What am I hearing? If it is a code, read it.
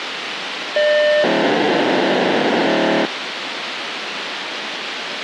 POCSAG pager data (1200 baud), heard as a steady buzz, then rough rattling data, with radio hiss.